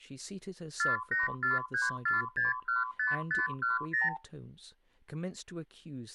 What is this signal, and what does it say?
Multi-frequency trunk signalling (R2, with the far end's replies), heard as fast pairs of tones, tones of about 160 ms, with speech in English. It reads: 48434615510